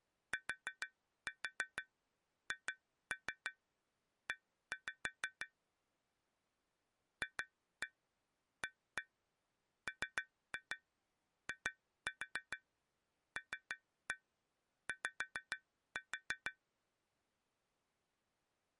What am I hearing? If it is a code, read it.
Tap code, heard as taps on glass, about 6 knocks a second. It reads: THE FAMILY